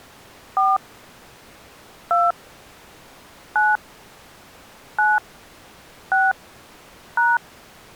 DTMF, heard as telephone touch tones, dialled by hand, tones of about 200 ms. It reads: 4 2 9 9 6 #